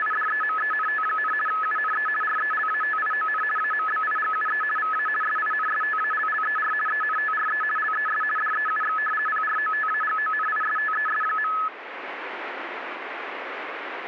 RTTY (50 baud, 450 Hz shift), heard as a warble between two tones, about 1500 Hz centre, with radio static. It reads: … UNE RELATION AMBIGUE VA SINSTALLER ENTRE LES DEUX PROTAGONISTES.